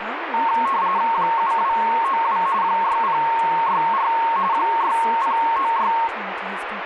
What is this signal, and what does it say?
RTTY (45.45 baud, 170 Hz shift), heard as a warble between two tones, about 1000 Hz centre, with radio static and speech in English. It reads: 7292 6064 6096